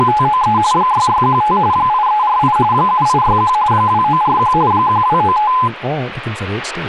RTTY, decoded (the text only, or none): … 6615 8348 7861 2941 1295